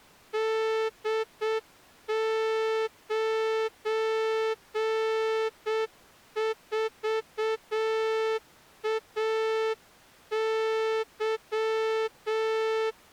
Morse code, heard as a horn, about 7 wpm. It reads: D94AY